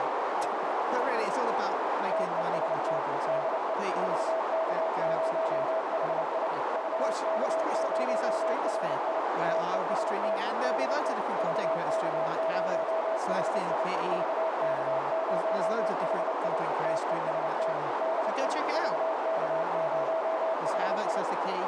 Morse code, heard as a keyed tone, machine-sent, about 29 wpm, 650 Hz, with heavy radio static, a narrow filter and speech in English. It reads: TEST DE VK0HI VK0HI TEST DE VK0HI VK0HI TEST DE VK0HI